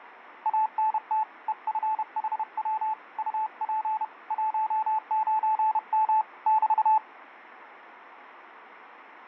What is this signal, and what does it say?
Morse code, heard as a keyed tone, hand-sent with a paddle, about 31 wpm, 870 Hz, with radio static. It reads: ANT EFHW UP 19M <BT>